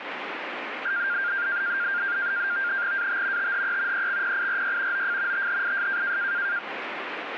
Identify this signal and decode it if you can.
NAVTEX (SITOR-B), 100 baud, 170 Hz shift, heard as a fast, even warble, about 1500 Hz centre, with radio static. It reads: AT THE EXPIRY OF THIS